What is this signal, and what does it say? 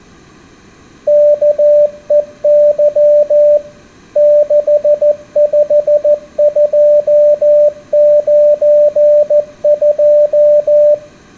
Morse code, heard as a keyed tone, machine-sent, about 14 wpm, 590 Hz, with room echo. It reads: KEY 65292